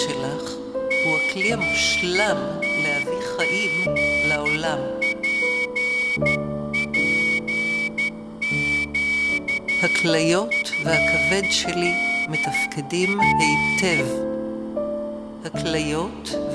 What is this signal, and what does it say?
Morse code (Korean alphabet), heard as a whistle, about 12 wpm, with room echo. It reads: 첫째는